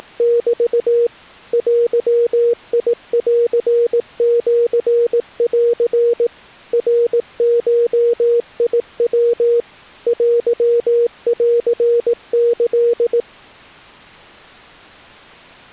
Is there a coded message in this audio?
Yes: Morse code (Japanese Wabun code) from 0.0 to 13.3 s, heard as a keyed tone, machine-sent, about 18 wpm, 470 Hz. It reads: … デンシン ナゴヤ テンキ